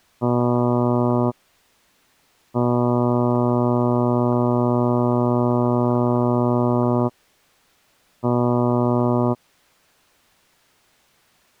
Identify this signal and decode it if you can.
Ship horn signal, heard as a ship's horn, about 120 Hz. 1 short, 1 long, 1 short. At sea: a vessel at anchor warns of its position.